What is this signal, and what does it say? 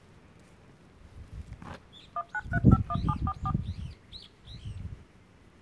DTMF, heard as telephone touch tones, dialled by machine, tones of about 50 ms, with the noise of a park. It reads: 19351744